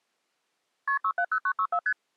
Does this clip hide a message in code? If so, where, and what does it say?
Yes: multi-frequency trunk signalling (R1, as on North American trunks) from 0.9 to 1.9 s, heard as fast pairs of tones, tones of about 70 ms. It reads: KP 670964 ST